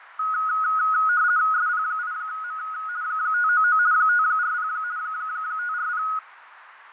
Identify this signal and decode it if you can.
RTTY (50 baud, 170 Hz shift), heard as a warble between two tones, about 1360 Hz centre, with radio static, fading and a narrow filter. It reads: SP8M 599 540 540